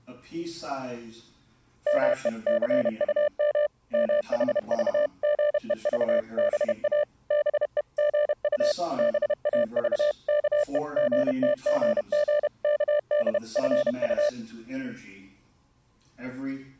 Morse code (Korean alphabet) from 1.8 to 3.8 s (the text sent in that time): 마침